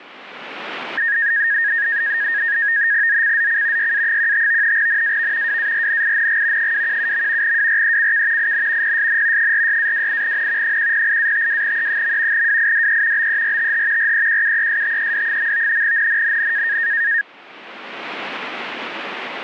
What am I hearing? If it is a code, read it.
NAVTEX (SITOR-B), 100 baud, 170 Hz shift, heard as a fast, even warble, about 1750 Hz centre. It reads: ZCZC YA15 NAV WARNING 217. WRECK IN PSN 46-28N 108-52E. WIDE BERTH REQUESTED. NNNN